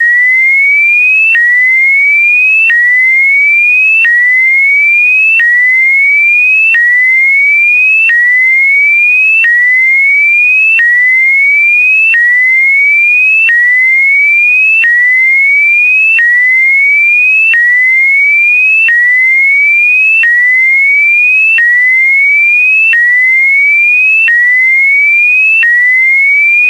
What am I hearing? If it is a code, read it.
A tone that sweeps in pitch again and again. There is no code.